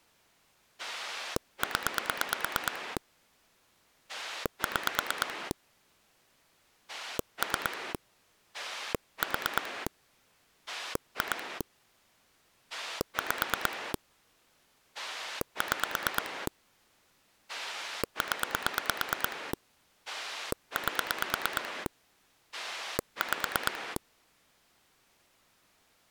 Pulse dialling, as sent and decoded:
10 / 6 / 3 / 4 / 2 / 5 / 6 / 10 / 8 / 5
0 6 3 4 2 5 6 0 8 5

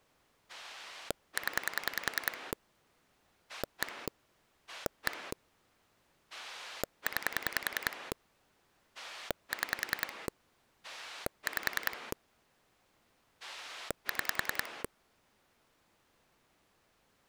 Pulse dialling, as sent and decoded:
10 / 1 / 1 / 9 / 6 / 5 / 6
0 1 1 9 6 5 6

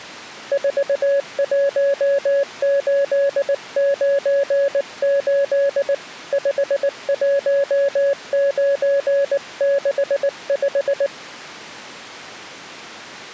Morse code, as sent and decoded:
....- .---- ---.. ----. ---.. / ..... .---- ----. -.... .....
41898 51965

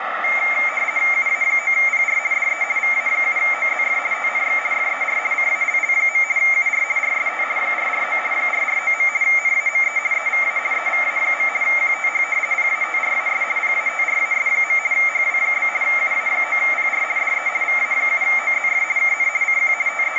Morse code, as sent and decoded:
none

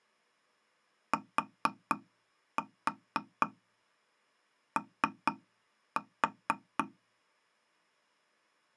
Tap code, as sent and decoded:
4-4 3-4
TO

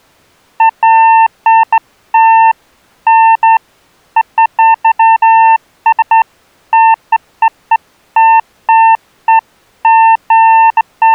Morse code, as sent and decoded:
none

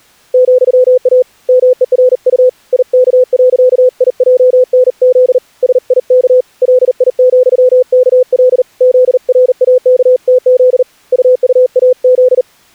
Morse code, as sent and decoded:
--..-- .- / -- . .-. ..- / .. -.- .-.-.- .. .--- -. --.. / ... .. -.- / .-.. .. --..-- -.- .-.. / --.. .-. .- -.- - --.. / ..- ..- .- --..
,A MERU IK.IJNZ SIK LI,KL ZRAKTZ UUAZ

